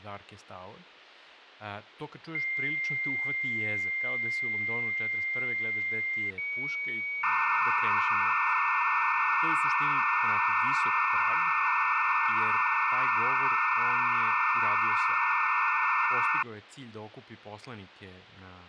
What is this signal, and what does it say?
Dial-up modem handshake (low-speed, two carriers), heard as two whistles, then hiss, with speech.